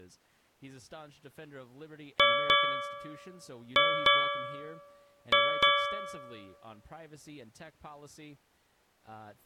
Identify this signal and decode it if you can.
Ship's bell, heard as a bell, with speech in English. 6. Six half-hours of the watch have passed.